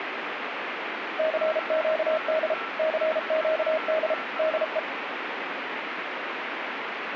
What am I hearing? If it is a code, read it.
Morse code, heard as a keyed tone, machine-sent, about 33 wpm, 630 Hz, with radio static and a weaker station near 1340 Hz. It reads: CQD CQD DE